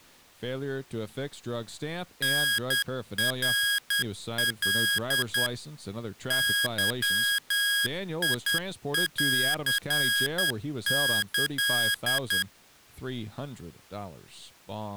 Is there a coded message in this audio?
Yes: Morse code (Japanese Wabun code) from 2.2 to 12.5 s, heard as electronic beeps, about 10 wpm, 1650 Hz, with speech in English. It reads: タナカ ゲンキ